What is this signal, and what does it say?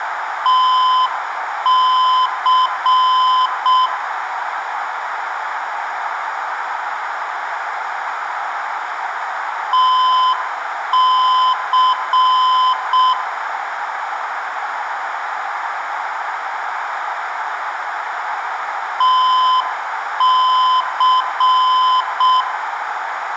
Morse code, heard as a keyed tone, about 6 wpm, 1020 Hz, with radio static, a narrow filter and room echo. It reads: TC TC TC